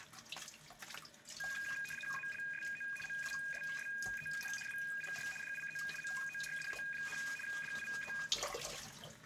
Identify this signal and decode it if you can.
RTTY (75 baud, 850 Hz shift), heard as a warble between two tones, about 2050 Hz centre, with room echo and kitchen noise. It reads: ALSO MUSSEN WIR DIE MORDE, DIE